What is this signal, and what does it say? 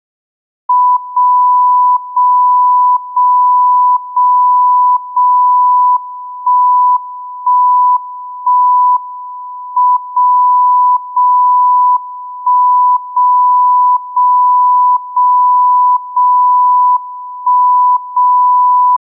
Radio time signal (WWVB), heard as a tone whose level steps once a second, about 990 Hz. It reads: 0 0 0 0 0 1 1 1 M 0 0 1 0 0 0 0 1 0